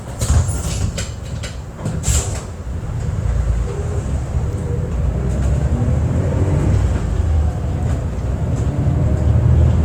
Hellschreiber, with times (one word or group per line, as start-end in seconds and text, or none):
none